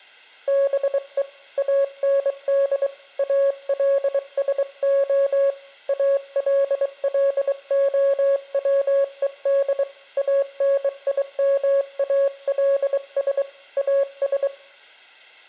Morse code, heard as a keyed tone, hand-sent with a bug key, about 23 wpm, 550 Hz. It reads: BE AND ALSO ALLOWED ANIMALS AS